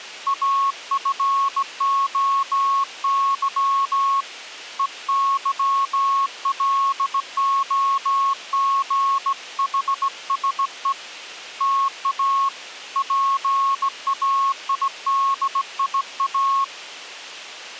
Morse code (Greek alphabet), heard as a keyed tone, hand-sent with a straight key, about 17 wpm, 1100 Hz. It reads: ΑΦΟΥ ΕΥΛΟΓΗΣΕ ΤΑ ΠΑΙΔΙΑ